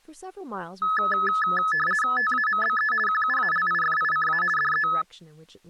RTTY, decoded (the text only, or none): TAMBE QUALIFICA DE